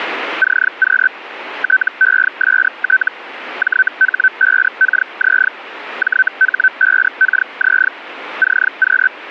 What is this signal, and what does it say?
Hellschreiber (Feld-Hell, 122.5 baud), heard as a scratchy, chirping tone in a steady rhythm, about 1550 Hz. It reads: CQ TEST JH5KZ JH5KZ CQ